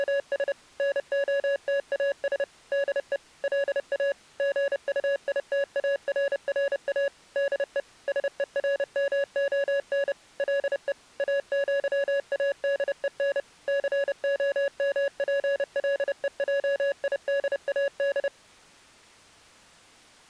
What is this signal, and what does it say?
Morse code (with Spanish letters), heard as electronic beeps, machine-sent, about 30 wpm, 560 Hz. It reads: … NOTAS DE LA GUITARRA DE SERMON LE AÑADEN COMPLEJIDAD